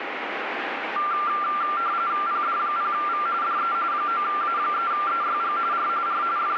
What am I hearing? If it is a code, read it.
RTTY (45.45 baud, 170 Hz shift), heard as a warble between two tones, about 1280 Hz centre, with radio static. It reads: PD0V DE 9A3EYG R R …